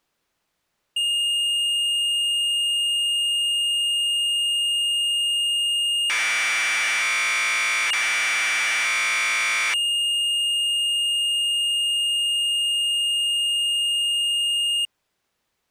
Commodore tape loading (standard loader), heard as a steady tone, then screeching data.